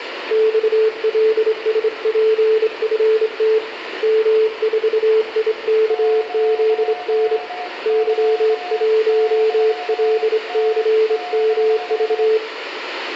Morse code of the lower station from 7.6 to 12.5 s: Y1LCMV

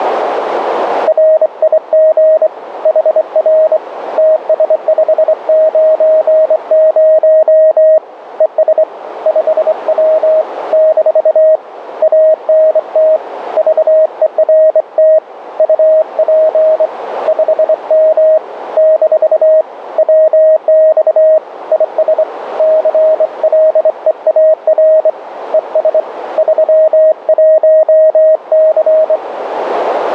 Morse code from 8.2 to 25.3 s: ES 5W - ANT VERT UP 5M - WX IS CLEAR

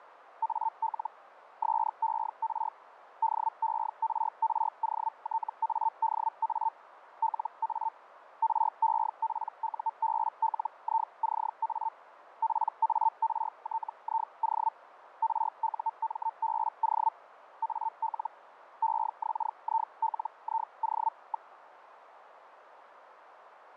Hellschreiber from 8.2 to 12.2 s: REPUBLICA

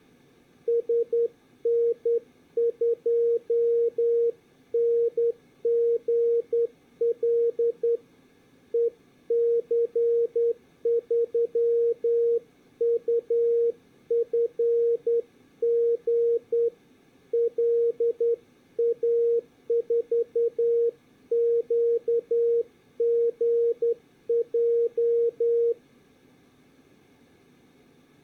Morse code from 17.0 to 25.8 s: LA4QGJ

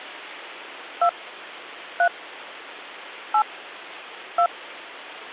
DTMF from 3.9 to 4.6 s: 2

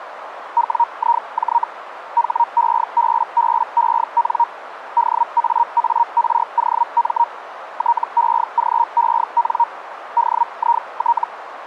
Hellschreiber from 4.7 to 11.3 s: DAAROM TEGEN DIT

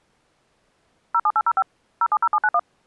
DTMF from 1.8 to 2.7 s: 070791

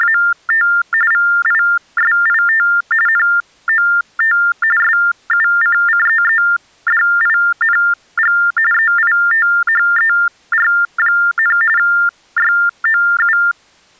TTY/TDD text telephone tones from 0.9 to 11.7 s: VISIT NOT SUCCEEDING EITHER,

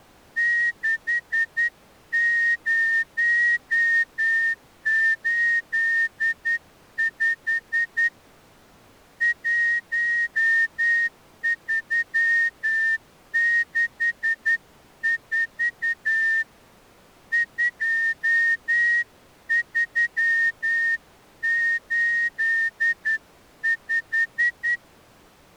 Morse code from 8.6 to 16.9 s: 1364

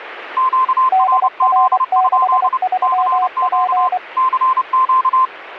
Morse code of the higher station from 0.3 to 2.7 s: QRZ?

